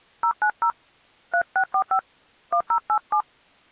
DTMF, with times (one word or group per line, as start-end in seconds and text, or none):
0.2-0.7 090
1.3-2.0 3645
2.5-3.2 1087